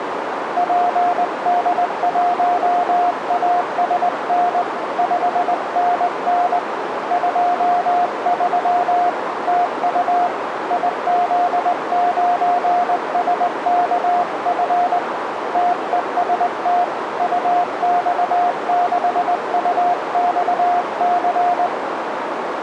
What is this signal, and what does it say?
Morse code, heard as a keyed tone, hand-sent with a straight key, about 20 wpm, 710 Hz, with radio static and a narrow filter. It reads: PD1ASN 5NN 23 TU IZ9SKF TEST UX6UXC